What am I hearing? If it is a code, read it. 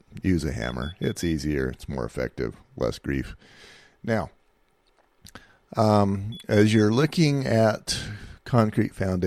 Alarm pattern, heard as an alarm's beeps, played twice, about 3400 Hz, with speech in English. Temporal four. Carbon monoxide.